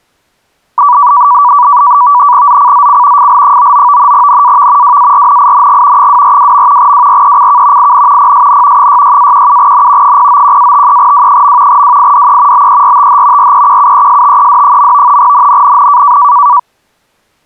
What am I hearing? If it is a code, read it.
NAVTEX (SITOR-B), 100 baud, 170 Hz shift, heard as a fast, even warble, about 1060 Hz centre. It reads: ZCZC FL99 NAV WARNING 242. WRECK IN PSN 66-17N 091-53W. WIDE BERTH REQUESTED. NNNN